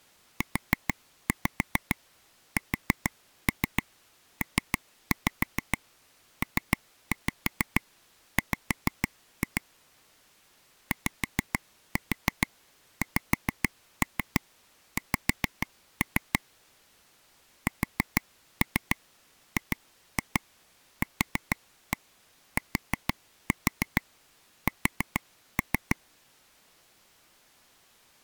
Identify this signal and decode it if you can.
Tap code, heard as taps on a table, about 6 knocks a second. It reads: USPPW YXX SGQTS